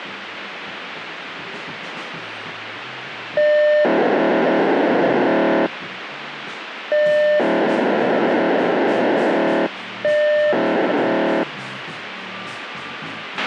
POCSAG pager data (1200 baud), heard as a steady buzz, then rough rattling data, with radio hiss and a squelch burst at the end.